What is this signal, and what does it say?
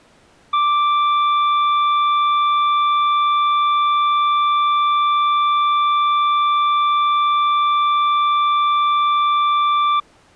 A steady tone. There is no code.